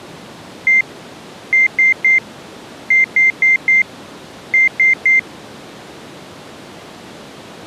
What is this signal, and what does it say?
Beep code, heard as beeps, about 2100 Hz. 1-3-4-3. In Phoenix BIOS tables: memory failure on data bits.